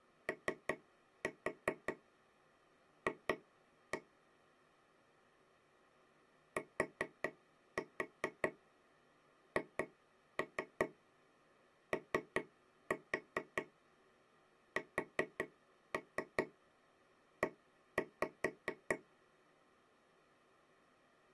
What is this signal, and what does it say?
Tap code, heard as taps on a table, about 4 knocks a second. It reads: OF THOSE